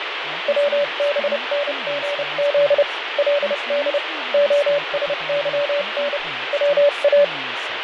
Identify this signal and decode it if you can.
Morse code (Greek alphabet), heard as a keyed tone, machine-sent, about 30 wpm, spaced as for 27 wpm, 580 Hz, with radio static, fading and speech in English. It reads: ΩΒΝΓΖ ΛΔ ΟΣΥΝ ΩΑ